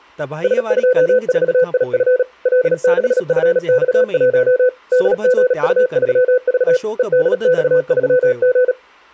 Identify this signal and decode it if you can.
Morse code, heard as a keyed tone, machine-sent, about 37 wpm, 500 Hz, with speech in Sindhi. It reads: S24IF L6FX1 DGU3V EDX3G